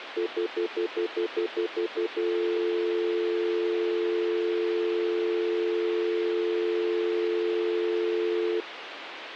Telephone call progress tone (North American plan), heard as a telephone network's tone, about 350, 440 Hz, 0.1 s on and 0.1 s off, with phone line noise. Stutter dial tone.